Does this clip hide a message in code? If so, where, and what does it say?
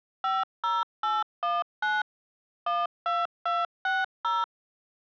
Yes: DTMF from 0.2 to 4.4 s, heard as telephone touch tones, dialled by machine, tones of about 200 ms. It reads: 50819 12260